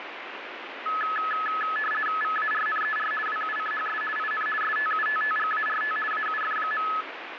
RTTY (50 baud, 450 Hz shift), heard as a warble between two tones, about 1500 Hz centre, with radio static. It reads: VARNER WUCHS IN STUTTGART AUF.